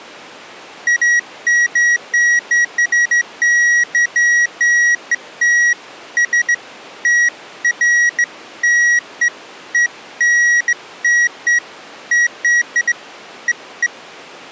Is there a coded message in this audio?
No, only beeps of irregular length.